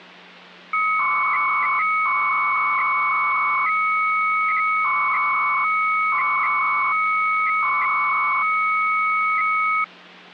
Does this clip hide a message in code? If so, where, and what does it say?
Yes: 300-baud modem data (Bell 103 tones) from 0.7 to 9.8 s, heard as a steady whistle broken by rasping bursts, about 300 baud, 200 Hz shift, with hum.